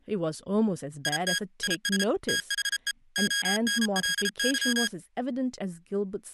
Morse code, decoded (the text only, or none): IT IS THE ONLY